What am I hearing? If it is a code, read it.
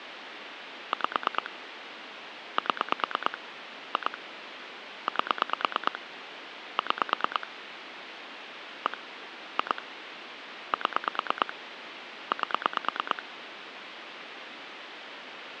Pulse dialling, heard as clicks on a phone line, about 9 pulses a second, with phone line noise. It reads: 5 7 2 8 6 1 2 7 8